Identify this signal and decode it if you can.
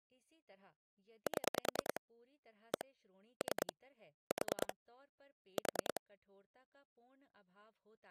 Pulse dialling, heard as clicks on a phone line, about 10 pulses a second, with speech in Hindi. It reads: 7 1 3 4 4